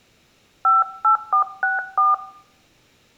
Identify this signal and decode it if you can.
DTMF, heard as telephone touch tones, dialled by hand, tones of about 160 ms. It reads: 58464